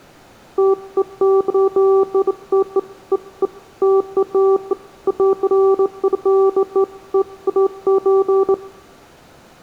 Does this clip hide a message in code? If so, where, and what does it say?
No, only beeps of irregular length, with room echo.